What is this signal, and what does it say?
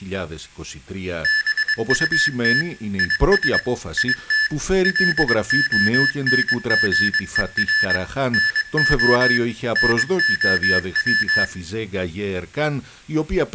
Morse code, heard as electronic beeps, machine-sent, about 22 wpm, 1750 Hz, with room echo and speech in Greek. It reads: BUT IS IT LONGER NO NOW